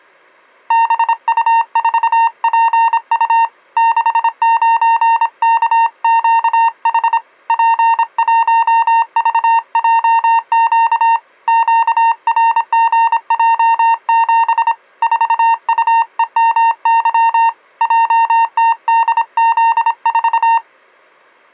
Morse code, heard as a keyed tone, hand-sent with a paddle, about 26 wpm, 920 Hz. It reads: BU4PU 69KQH P1VJQ QRGJ7 4UEMY JTDZ4